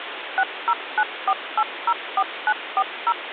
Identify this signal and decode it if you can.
DTMF, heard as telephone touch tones, dialled by machine, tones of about 60 ms, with phone line noise. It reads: 6094804940